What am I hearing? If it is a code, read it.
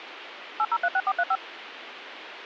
DTMF, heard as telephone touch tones, dialled by machine, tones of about 50 ms, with radio hiss. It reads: 8036435